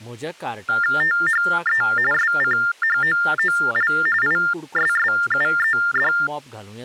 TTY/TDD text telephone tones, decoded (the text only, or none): THE SCHOOL ISSUED